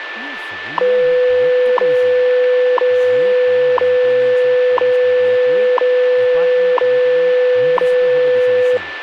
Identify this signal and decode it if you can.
Radio time signal (WWV, Colorado), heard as ticks, one a second, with radio static, a steady whistle near 1760 Hz and speech in Assamese.